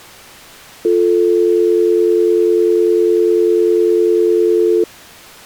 Telephone call progress tone (North American or UK plan), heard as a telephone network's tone, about 350, 440 Hz. Dial tone.